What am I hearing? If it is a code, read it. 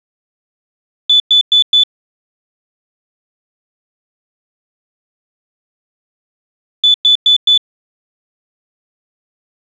Alarm pattern, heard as an alarm's beeps, played twice, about 3500 Hz. Temporal four. Carbon monoxide.